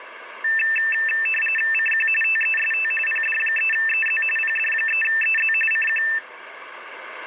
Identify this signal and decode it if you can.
RTTY (45.45 baud, 850 Hz shift), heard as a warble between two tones, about 2200 Hz centre, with radio static. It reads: CQ TEST PD3EZ PD3EZ CQ